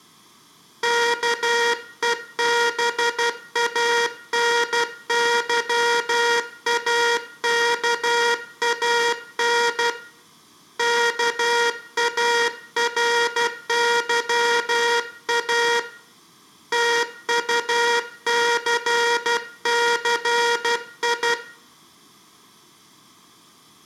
Morse code, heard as a buzzer, hand-sent with a paddle, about 12 wpm, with room echo. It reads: KEBANYAKAN KARYA TUCCI